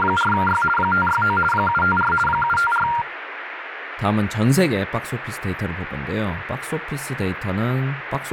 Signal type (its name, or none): RTTY